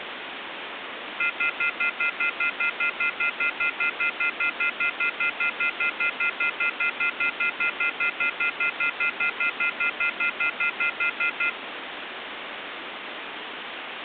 Telephone call progress tone (North American plan), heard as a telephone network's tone, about 1400, 2050, 2450, 2600 Hz, 0.1 s on and 0.1 s off, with phone line noise. Off-hook warning tone.